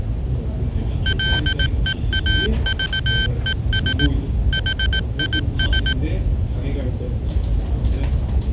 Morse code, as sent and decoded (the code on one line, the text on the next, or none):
.-.. . .- ...- . ... / .... .. ...
LEAVES HIS